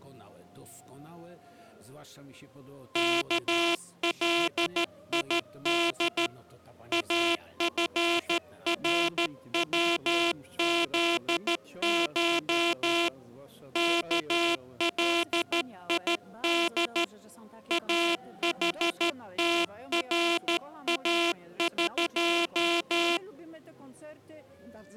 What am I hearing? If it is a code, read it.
Morse code (Persian alphabet), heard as a buzzer, hand-sent with a straight key, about 13 wpm. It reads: کلید افروزش کلید احتراق